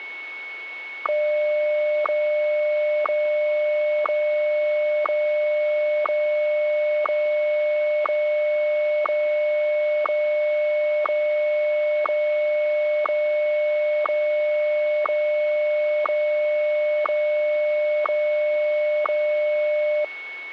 Radio time signal (WWVH, Hawaii), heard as ticks, one a second, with a steady whistle near 2210 Hz.